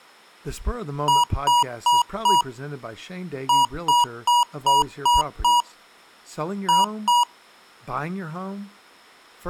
Beep code, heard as beeps from a small speaker, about 960 Hz, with speech in English. 4-6-2.